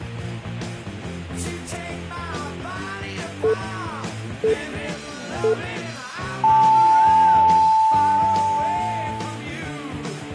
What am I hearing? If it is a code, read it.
Radio time signal (three low pips and a long one an octave up, as on NHK), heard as pips.